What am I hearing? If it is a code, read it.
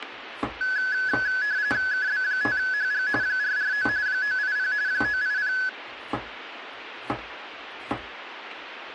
RTTY (45.45 baud, 170 Hz shift), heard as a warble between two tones, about 1600 Hz centre, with radio static and kitchen noise. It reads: KB5HG 449 980 980